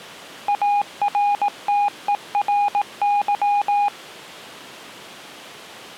Morse code, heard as a keyed tone, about 18 wpm, 820 Hz. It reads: ARTERY